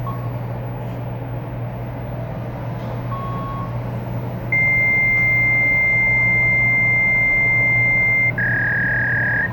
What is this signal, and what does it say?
Fax machine handshake, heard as a beep, a long tone and a warble, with the noise inside a lift.